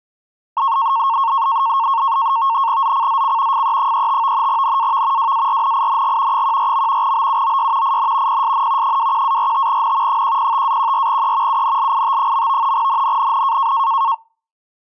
NAVTEX (SITOR-B), 100 baud, 170 Hz shift, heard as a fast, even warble, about 1000 Hz centre. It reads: ZCZC FE35 NAV WARNING 14. BUOY IN PSN 21-45N 105-14E UNLIT. NNNN